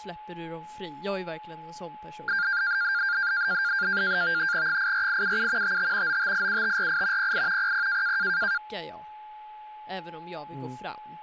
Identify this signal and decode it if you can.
NAVTEX (SITOR-B), 100 baud, 170 Hz shift, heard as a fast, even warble, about 1500 Hz centre, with a steady whistle near 850 Hz and speech in Swedish. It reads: 84877 55 9587548 08 00